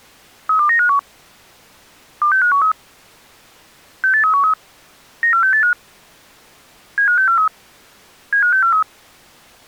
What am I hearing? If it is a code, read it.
Five-tone selective call (CCIR), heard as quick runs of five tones, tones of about 100 ms. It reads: 32951 26513 68313 94685 75643 75643